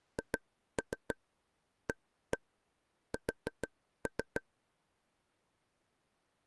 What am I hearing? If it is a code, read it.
Tap code, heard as taps on a table, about 6 knocks a second. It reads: HAS